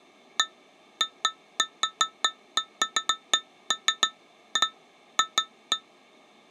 Irregular taps on glass. There is no code.